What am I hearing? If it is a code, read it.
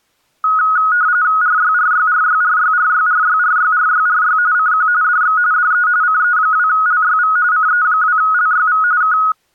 RTTY (45.45 baud, 170 Hz shift), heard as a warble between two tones, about 1360 Hz centre. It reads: RYRYRYRYRYRYRYRYRY CQ DX DE CE2LYV CE2LYV K